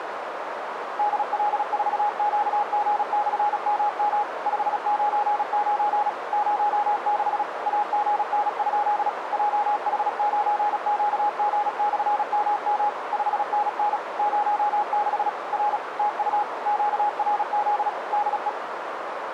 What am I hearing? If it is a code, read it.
Morse code, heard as a keyed tone, machine-sent, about 36 wpm, 830 Hz, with radio static and a narrow filter. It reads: DL4QG/MM 599 06 AGN? JH9QG/MM 5NN 06 R TU QRZ DE